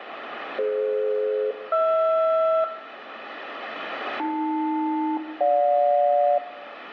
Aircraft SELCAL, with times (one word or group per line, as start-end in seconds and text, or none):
0.6-2.6 DF-HR
4.2-6.4 AL-GJ